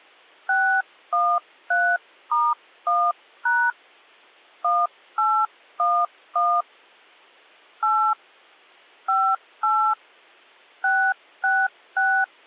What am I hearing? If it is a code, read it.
DTMF, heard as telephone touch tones, dialled by hand, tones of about 260 ms. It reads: 613*1# 1811 8 58 666